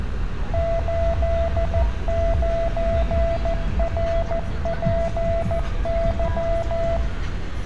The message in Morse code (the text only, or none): 89RPY